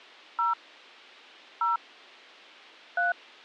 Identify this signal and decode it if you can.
DTMF, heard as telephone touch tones, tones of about 150 ms. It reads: 0 0 3